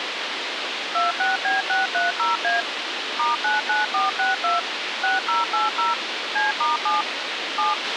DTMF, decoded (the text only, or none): 26B630A *99462 6080 C*7 7